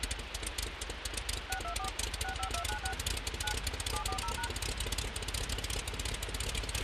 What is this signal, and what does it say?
DTMF, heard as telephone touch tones, dialled by machine, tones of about 100 ms, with radio hiss and a squelch burst at the end. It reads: 624 65296 9 740#